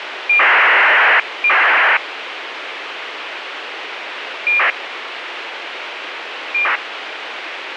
ACARS aircraft data, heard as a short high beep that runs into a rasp, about 2400 baud, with radio hiss and a squelch burst at the end.